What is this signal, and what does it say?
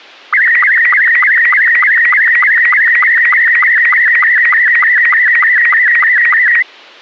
SSTV (slow-scan television), Robot 72, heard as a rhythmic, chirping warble.